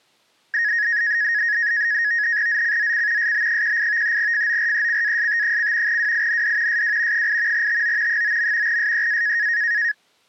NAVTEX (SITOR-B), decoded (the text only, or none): ZCZC SB18 FORECAST: WIND SW 8 TO 9. SEA